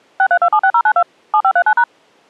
DTMF, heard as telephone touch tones, dialled by machine, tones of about 70 ms. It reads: 63276092 7539#